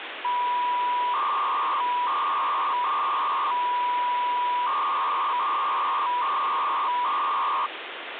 300-baud modem data (V.21 tones), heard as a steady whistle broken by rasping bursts, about 300 baud, 200 Hz shift, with phone line noise.